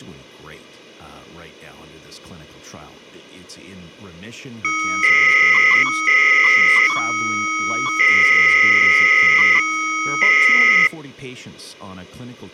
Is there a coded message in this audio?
Yes: 300-baud modem data (Bell 103 tones) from 4.6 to 10.9 s, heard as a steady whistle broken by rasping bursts, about 300 baud, 200 Hz shift, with speech in English.